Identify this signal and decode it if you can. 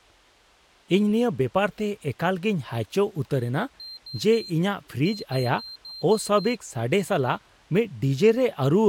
Beep code, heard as a piezo beeper, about 4150 Hz, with speech in Santali. 3-6.